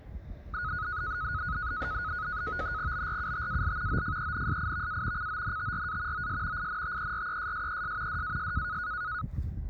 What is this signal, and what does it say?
NAVTEX (SITOR-B), 100 baud, 170 Hz shift, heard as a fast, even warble, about 1360 Hz centre, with the noise of a residential street. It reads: BRUTAL OFENSIVA CONTRA OS INTERESSES DAS